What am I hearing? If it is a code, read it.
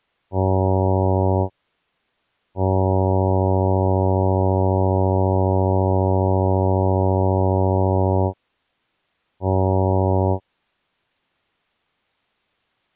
Ship horn signal, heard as a ship's horn, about 100 Hz. 1 short, 1 long, 1 short. At sea: a vessel at anchor warns of its position.